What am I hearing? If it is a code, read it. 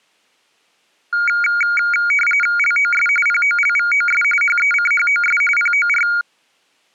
RTTY (45.45 baud, 850 Hz shift), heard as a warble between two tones, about 1850 Hz centre. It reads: LOS POLVOS HECHOS POR